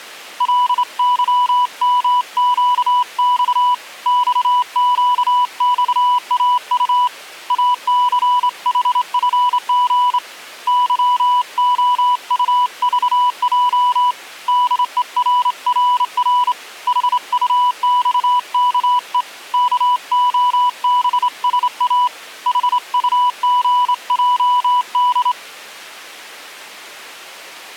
Morse code, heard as a keyed tone, hand-sent with a straight key, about 27 wpm, 990 Hz. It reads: LYMQX XQXAU ACHFG YOUVJ DERRR HUXKE KOBSA HUGJD